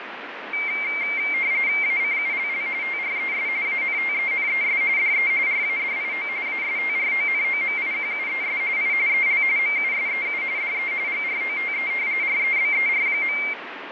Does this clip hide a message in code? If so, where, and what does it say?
Yes: RTTY (45.45 baud, 170 Hz shift) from 0.5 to 13.5 s, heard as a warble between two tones, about 2200 Hz centre, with radio static. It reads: ACULL TRES ANTENES DE RADIO ASTRONOMIQUES I EL MUSEU DE GROTE REBER.